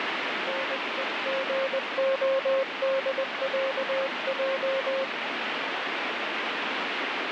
Morse code (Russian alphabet), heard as a keyed tone, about 20 wpm, 540 Hz, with heavy radio static. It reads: НЕГОДЯЙ